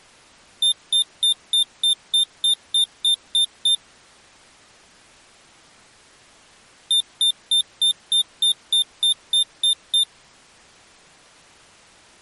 Beep code, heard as a piezo beeper, played twice, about 3600 Hz. 11 short. In AMI BIOS tables: cache memory error.